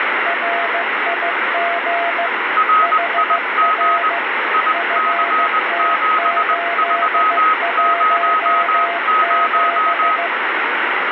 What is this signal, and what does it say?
Morse code, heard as two keyed tones, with heavy radio static. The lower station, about 15 wpm, 690 Hz: RIG HR FT817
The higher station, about 20 wpm, 1270 Hz: RIG IC7300